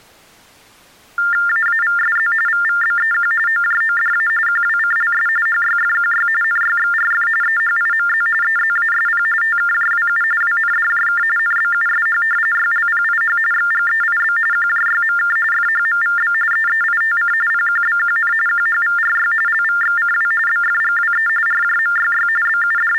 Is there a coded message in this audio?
Yes: TTY/TDD text telephone tones (45.45 baud Baudot) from 1.2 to 23.0 s, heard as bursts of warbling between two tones, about 400 Hz shift, 1600 Hz centre. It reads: AAVSZ VVBEQ OJODA QWCLS HYFQY NYXRF EHIMZ EZASP TKJWU WNDJK NBUSH YLPIH XGEIB QJYMK FHMVB EEITC PQBQN QHVRY LVXCW BFGWE RJMYY …